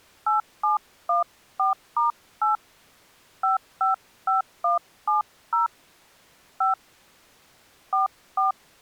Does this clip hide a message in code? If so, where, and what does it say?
Yes: DTMF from 0.3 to 8.5 s, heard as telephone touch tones, dialled by hand, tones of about 140 ms. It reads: 8714*8 555170 5 44